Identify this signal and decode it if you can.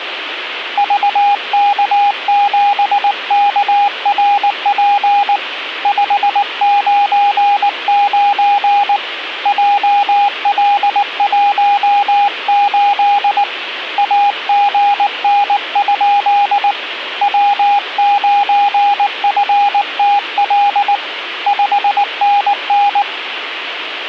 Morse code, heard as a keyed tone, hand-sent with a paddle, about 19 wpm, 810 Hz, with radio static. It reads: VK7KRP 599 JL18 AGN? W9FTL 5NN